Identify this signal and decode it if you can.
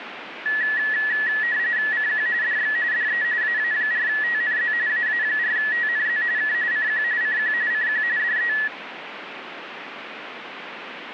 RTTY (45.45 baud, 170 Hz shift), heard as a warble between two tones, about 1800 Hz centre, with radio static. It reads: CQ DX DE AA4TNZ AA4TNZ K CQ CQ CQ DE